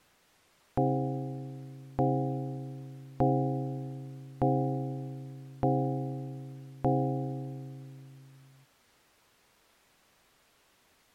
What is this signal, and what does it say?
Clock strike, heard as a bell. 6. Six o'clock.